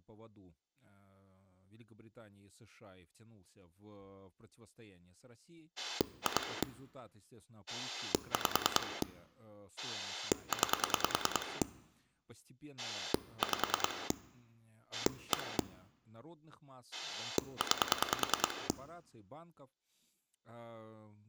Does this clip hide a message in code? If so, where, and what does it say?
Yes: pulse dialling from 5.8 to 18.7 s, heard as a rotary dial, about 10 pulses a second, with speech in Russian. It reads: 2 5 9 5 1 9